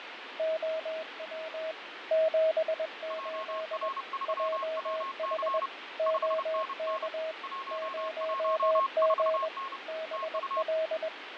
Morse code, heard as two keyed tones, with radio static and fading. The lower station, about 21 wpm, 640 Hz: OW 78 JH OK 0G BL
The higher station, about 30 wpm, 1080 Hz: JR3WC 5NN 114N TU